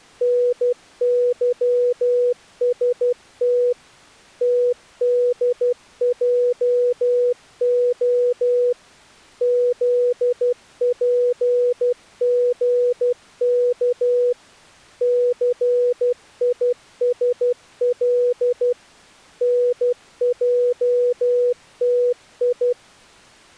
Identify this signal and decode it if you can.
Morse code, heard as a keyed tone, machine-sent, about 12 wpm, 490 Hz. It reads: NYST TDJO ZPGK CISL NJTI